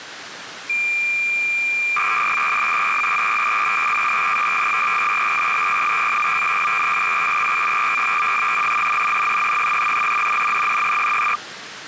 Cassette data (Kansas City type), 300 baud, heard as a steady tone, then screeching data, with tape hiss.